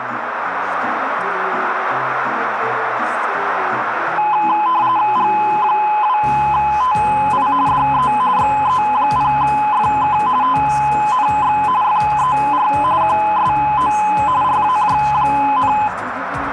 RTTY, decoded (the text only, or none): G2TI DE XE0FK TNX FER QSO RAJ,